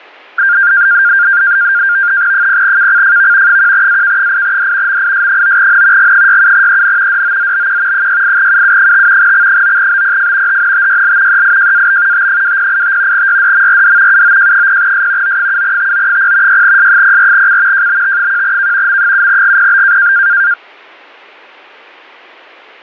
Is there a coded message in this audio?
Yes: NAVTEX (SITOR-B), 100 baud, 170 Hz shift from 0.4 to 20.5 s, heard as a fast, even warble, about 1500 Hz centre. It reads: 0KCFV 1AK8D MIS9N G67EN DOZBQ 68UU5 X9BPF HNTYL EIJAB T2085 YDMRD UOJ0S O7TO0 6S04C JBT1K M7GPB